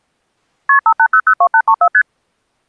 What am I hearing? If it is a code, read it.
Multi-frequency trunk signalling (R1, as on North American trunks), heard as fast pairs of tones, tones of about 70 ms. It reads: KP 58002834 ST